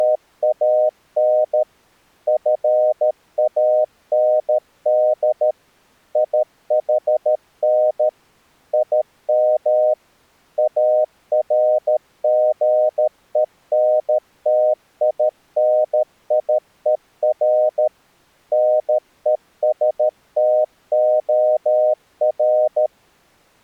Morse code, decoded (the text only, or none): … FAND IHN IM ARGENTINIER NESTOR